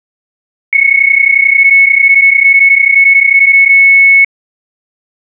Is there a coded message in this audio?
Yes: PSK31 (31.25 baud) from 0.7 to 4.2 s, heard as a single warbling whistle, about 2200 Hz.